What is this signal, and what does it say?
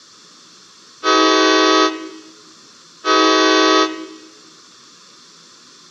Train horn signal, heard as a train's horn, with room echo. 2 short. On North American railways: a signal is acknowledged.